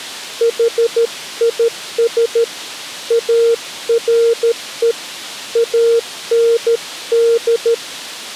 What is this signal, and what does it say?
Morse code, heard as a keyed tone, hand-sent with a paddle, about 13 wpm, 460 Hz. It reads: HIS ARE AND